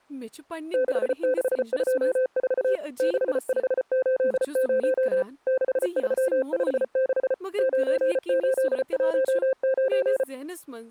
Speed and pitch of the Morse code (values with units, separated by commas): 34 wpm, 520 Hz